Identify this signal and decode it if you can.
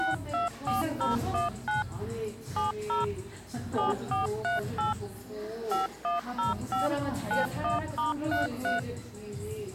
DTMF, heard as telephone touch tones, dialled by machine, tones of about 150 ms, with the noise of a cafe. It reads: 624019 70 7438 5105 91*33